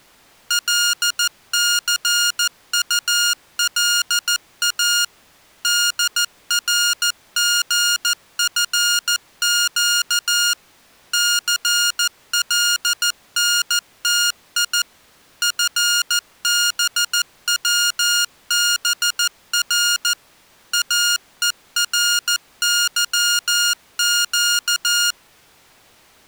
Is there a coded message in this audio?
Yes: Morse code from 0.4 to 25.2 s, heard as electronic beeps, machine-sent, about 14 wpm, 1420 Hz. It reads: LCULA DRGFQ CLNTI FBWBR AERYQ